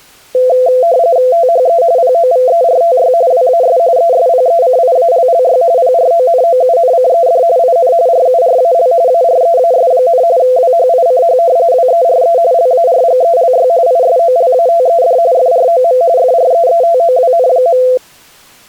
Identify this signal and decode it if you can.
RTTY (45.45 baud, 170 Hz shift), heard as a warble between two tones, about 590 Hz centre. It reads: THE POVERTY WAS ESPECIALLY PRONOUNCED IN RURAL AREAS, WHICH WERE LARGELY ISOLATED FROM FREETOWN.